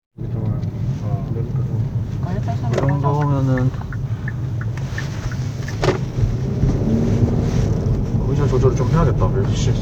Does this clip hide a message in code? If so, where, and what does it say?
No, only the noise inside a car.